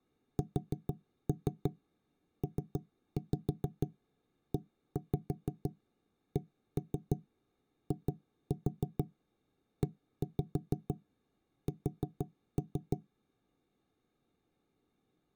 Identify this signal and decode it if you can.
Tap code, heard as knocks on wood, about 6 knocks a second. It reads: SPECIES